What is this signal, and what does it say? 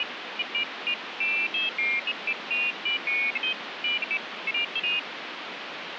Pairs of high tones at irregular times, with phone line noise. There is no code.